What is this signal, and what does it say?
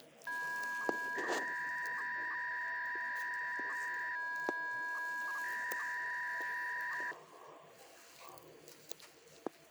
300-baud modem data (V.21 tones), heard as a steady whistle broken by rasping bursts, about 300 baud, 200 Hz shift, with hum and the noise inside a lift.